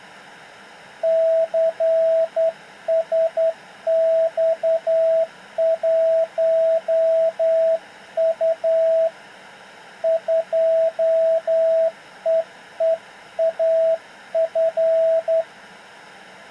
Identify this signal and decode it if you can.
Morse code, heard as a keyed tone, hand-sent with a straight key, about 10 wpm, 650 Hz. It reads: CSX1U 2EEAF